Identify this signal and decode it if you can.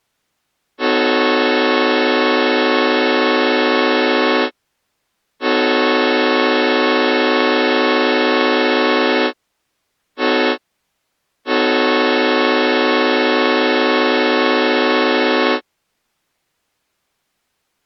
Train horn signal, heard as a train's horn. 2 long, 1 short, 1 long. On North American railways: approaching a public crossing.